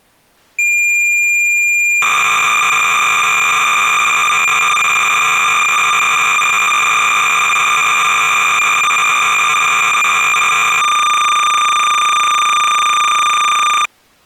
Cassette data (Kansas City type), 300 baud, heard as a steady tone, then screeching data.